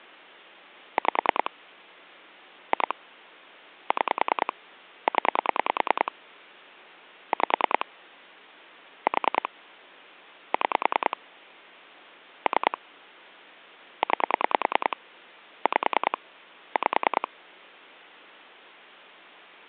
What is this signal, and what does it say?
Pulse dialling, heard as clicks on a phone line, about 10 pulses a second. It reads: 5 2 6 0 5 4 6 3 9 5 5